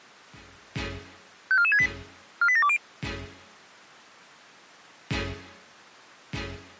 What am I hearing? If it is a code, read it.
Five-tone selective call (ZVEI), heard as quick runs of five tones, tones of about 70 ms. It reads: 54468 48720